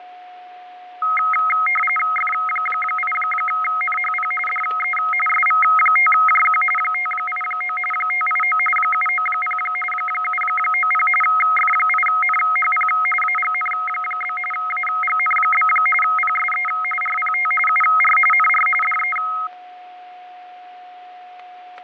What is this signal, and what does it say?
RTTY (45.45 baud, 850 Hz shift), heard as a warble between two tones, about 1700 Hz centre, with fading, static crashes and a steady whistle near 730 Hz. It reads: F8NHP DE SV5JQ 589 589 790 790 F8NHP AGN? AGN? PSE RPT UR NR DE